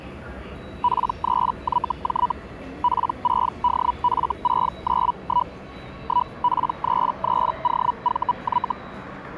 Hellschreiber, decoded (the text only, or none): P3YJ P6DF691 1P33OVY